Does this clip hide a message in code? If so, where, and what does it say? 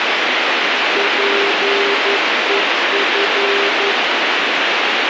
Yes: Morse code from 0.9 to 4.0 s, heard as a keyed tone, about 11 wpm, 400 Hz, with radio hiss. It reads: PEF